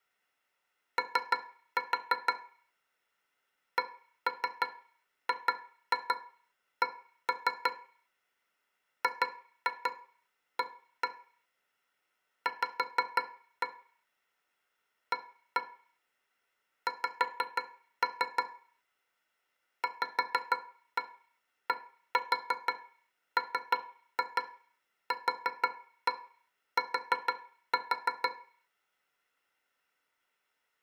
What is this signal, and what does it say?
Tap code, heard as taps on a metal pipe, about 6 knocks a second, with room echo. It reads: O CGC GA V A X VDMQT